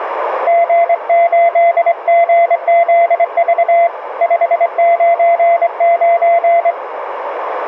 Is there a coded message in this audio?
Yes: Morse code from 0.4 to 6.8 s, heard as a keyed tone, hand-sent with a straight key, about 24 wpm, 680 Hz, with radio static and a narrow filter. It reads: G8GZV 599